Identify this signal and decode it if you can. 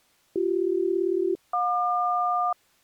Aircraft SELCAL, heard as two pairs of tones. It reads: BC-JQ